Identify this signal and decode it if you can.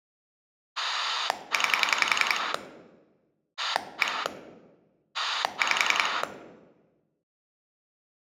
Pulse dialling, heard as a rotary dial, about 10 pulses a second, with room echo. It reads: 9 1 5